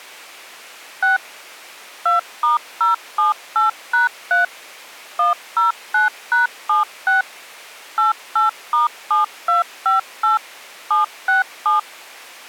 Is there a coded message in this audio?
Yes: DTMF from 1.0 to 11.8 s, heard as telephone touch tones, dialled by machine, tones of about 140 ms. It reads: 6 2*078#3 109#76 88*7258 767